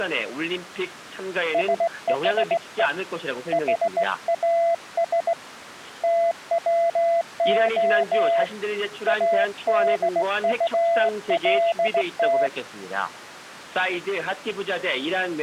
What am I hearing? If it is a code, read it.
Morse code, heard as a keyed tone, hand-sent with a straight key, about 17 wpm, 680 Hz. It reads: SHE HAS TWO ADULT